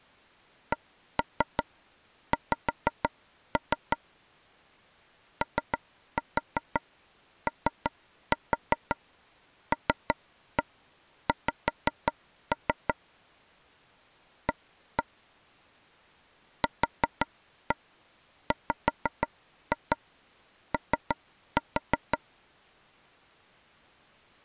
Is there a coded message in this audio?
Yes: tap code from 0.7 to 22.2 s, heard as taps on a table, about 5 knocks a second. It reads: CX OOLX A QWO